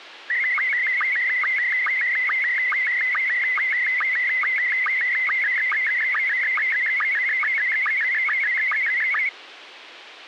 SSTV (slow-scan television), Scottie S1, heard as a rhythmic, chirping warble, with radio hiss.